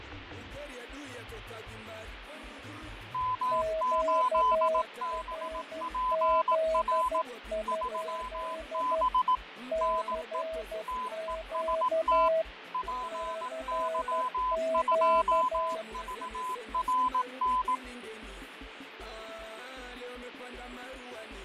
Morse code, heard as two keyed tones, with radio static and fading. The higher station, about 18 wpm, 1010 Hz: M8BPR 3B NE TEST PY2VRN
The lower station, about 12 wpm, 640 Hz: QRZ? CQ CQ